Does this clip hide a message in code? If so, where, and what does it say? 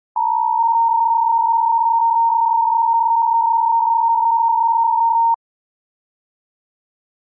Yes: PSK63 (62.5 baud) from 0.2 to 5.3 s, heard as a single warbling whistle, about 920 Hz.